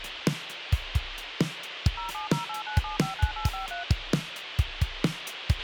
DTMF, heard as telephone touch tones, dialled by machine, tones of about 130 ms, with radio hiss and a squelch burst at the end. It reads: 07089759853